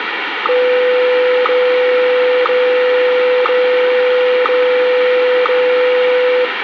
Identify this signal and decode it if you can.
Radio time signal (WWVH, Hawaii), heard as ticks, one a second, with radio static and room echo.